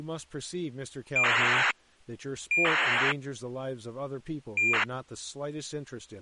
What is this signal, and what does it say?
ACARS aircraft data, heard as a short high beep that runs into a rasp, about 2400 baud, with speech in English.